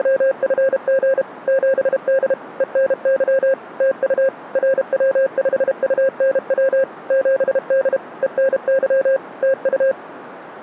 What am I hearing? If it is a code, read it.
Morse code, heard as a keyed tone, machine-sent, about 32 wpm, 540 Hz. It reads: … 7D ENY TU RW5UNW 7D ENY TU